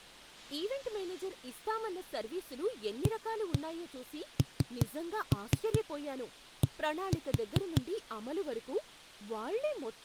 Tap code, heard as knocks on a wall, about 5 knocks a second, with speech in Telugu. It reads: AND